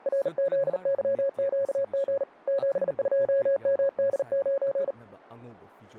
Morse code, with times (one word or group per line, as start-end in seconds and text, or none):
0.1-2.2 RZYQG
2.5-4.9 72MD9